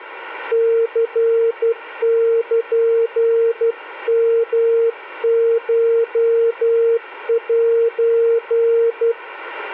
Morse code (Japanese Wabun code), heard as a keyed tone, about 12 wpm, 460 Hz. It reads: ニルヨコセ